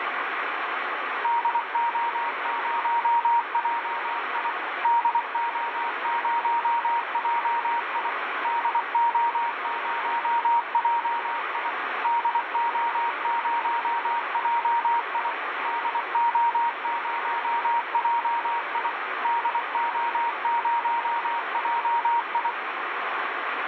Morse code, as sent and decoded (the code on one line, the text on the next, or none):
-.. --- ----- .--- .. / -.. --- ----- .--- .. / -.. --- ----- .--- .. / -.. --- ----- .--- .. / -.. --- ----- .--- .. / -.. --- ----- .--- ..
DO0JI DO0JI DO0JI DO0JI DO0JI DO0JI